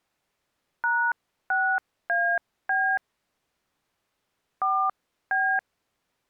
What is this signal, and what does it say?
DTMF, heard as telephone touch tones, dialled by hand, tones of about 280 ms. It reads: #6AB 4B